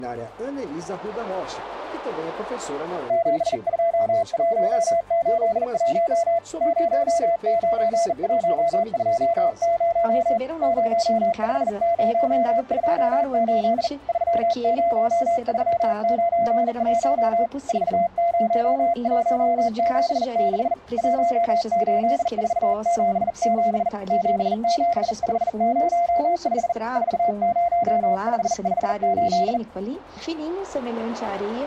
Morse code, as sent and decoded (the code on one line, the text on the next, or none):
--... ..--- .---- ---.. .---- / ----- ----. .---- ..--- ----- / ----- ..... ----- ..--- ---.. / ...-- ----- ...-- ----. .---- / ....- ----- .---- --... -.... / .---- ---.. ....- --... --... / --... --... ..... ----- ..... / ....- ----- ..... ..... ---..
72181 09120 05028 30391 40176 18477 77505 40558